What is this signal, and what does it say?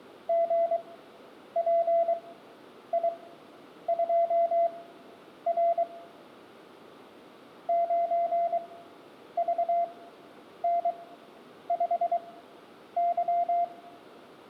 Morse code, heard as a keyed tone, machine-sent, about 23 wpm, spaced as for 9 wpm, 680 Hz, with room echo. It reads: GPI2R 9VN5Y